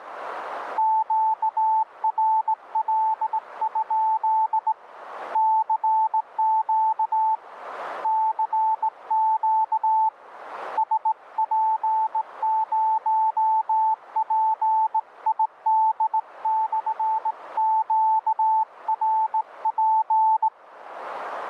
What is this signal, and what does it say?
Morse code, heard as a keyed tone, hand-sent with a straight key, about 18 wpm, 880 Hz, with radio static. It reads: QRL? CQ CQ SP0PID/QRP